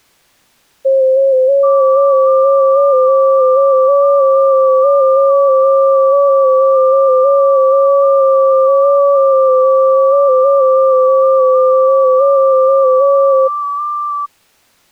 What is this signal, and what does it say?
FT8 (several signals at once), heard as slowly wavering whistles, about 6.25 baud.